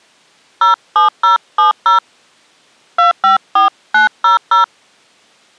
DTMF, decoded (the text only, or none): 07070 254900